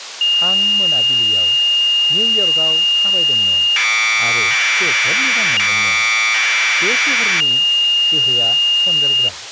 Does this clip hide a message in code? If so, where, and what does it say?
Yes: Commodore tape loading (standard loader) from 0.2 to 9.3 s, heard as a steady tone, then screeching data, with speech in Bodo.